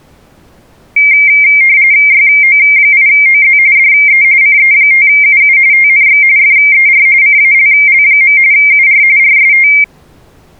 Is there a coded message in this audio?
Yes: RTTY (45.45 baud, 170 Hz shift) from 1.0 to 9.8 s, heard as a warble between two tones, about 2200 Hz centre. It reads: YO8OZ DE CE5UU TNX FER CALL. UR RST